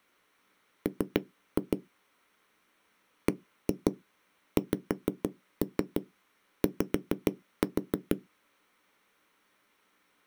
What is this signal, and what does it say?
Tap code, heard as knocks on a wall, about 6 knocks a second. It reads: M BXY